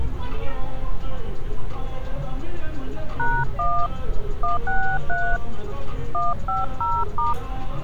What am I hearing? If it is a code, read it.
DTMF, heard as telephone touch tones, dialled by hand, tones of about 220 ms, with street noise. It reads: #1 163 150*